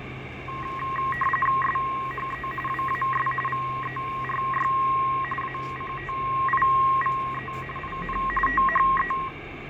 RTTY (45.45 baud, 850 Hz shift), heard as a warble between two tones, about 1490 Hz centre, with radio static, fading and street noise. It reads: SHE WAS VERY ACTIVE IN THE